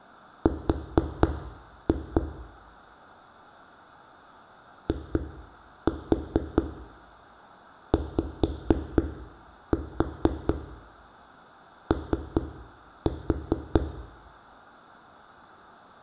Tap code, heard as knocks on a wall, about 4 knocks a second, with room echo. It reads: R IYO